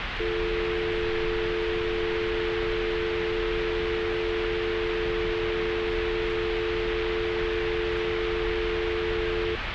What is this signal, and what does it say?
Telephone call progress tone (North American or UK plan), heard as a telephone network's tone, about 350, 440 Hz, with phone line noise and street noise. Dial tone.